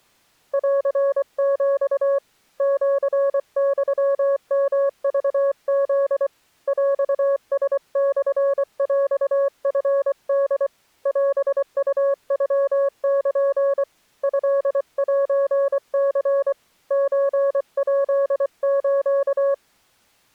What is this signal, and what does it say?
Morse code (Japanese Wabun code), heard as a keyed tone, hand-sent with a paddle, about 24 wpm, 560 Hz. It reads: ンヒ シユヨクフ ヰラモヰチホ オウノル トセニ ソヱス